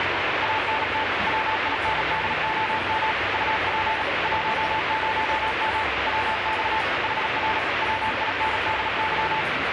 Morse code, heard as a keyed tone, machine-sent, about 37 wpm, 880 Hz, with heavy radio static and the noise of a restaurant. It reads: ANT WINDOM UP 10M WX HR WINDY